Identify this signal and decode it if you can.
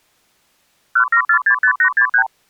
Multi-frequency trunk signalling (R2, with the far end's replies), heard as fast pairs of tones, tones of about 80 ms. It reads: 17465863